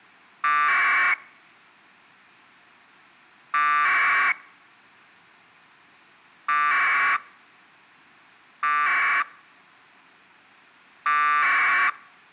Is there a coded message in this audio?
Yes: packet radio (AX.25, as in APRS), 1200 baud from 0.4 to 11.9 s, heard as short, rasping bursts.